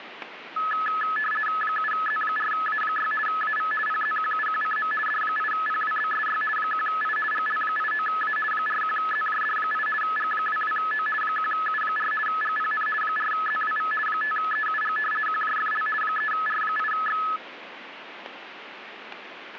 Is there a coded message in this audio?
Yes: RTTY (50 baud, 450 Hz shift) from 0.6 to 17.4 s, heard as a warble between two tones, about 1500 Hz centre, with radio static. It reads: 7Z4A6 AV PZQUQCM D8PWBSY 1I GL89A 41ZJD8 G22O 1U4 GPN 4ZWV 5EUG QJFL 3R8X